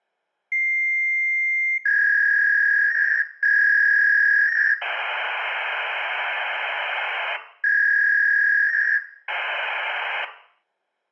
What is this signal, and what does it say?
Fax machine handshake, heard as a long tone, a warble and hiss, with room echo.